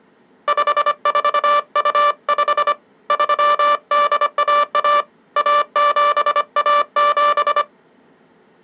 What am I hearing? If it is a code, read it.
Morse code (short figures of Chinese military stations), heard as a buzzer, hand-sent with a paddle, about 25 wpm. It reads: 5425 3811 1717